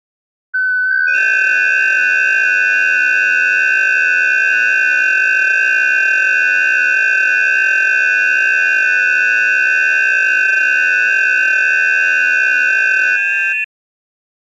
FT8 (several signals at once), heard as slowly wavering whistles, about 6.25 baud.